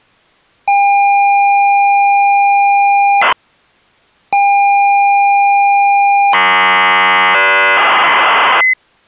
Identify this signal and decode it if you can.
ZX Spectrum tape loading, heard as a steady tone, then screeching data.